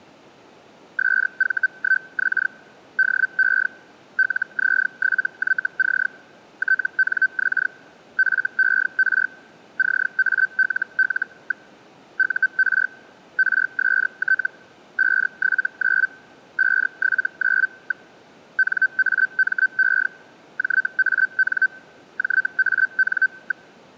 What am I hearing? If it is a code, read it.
Hellschreiber (Feld-Hell, 122.5 baud), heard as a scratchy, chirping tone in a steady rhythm, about 1550 Hz. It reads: SV1X DE LZ7YC TNX FER CALL. UR RST 579 579. NAME JAN JAN.